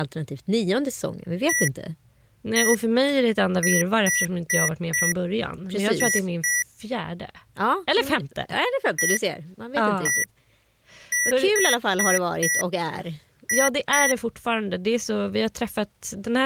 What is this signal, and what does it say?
Beep code, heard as beeps from a small speaker, played twice, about 1950 Hz, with speech in Swedish. 1-1-4-2.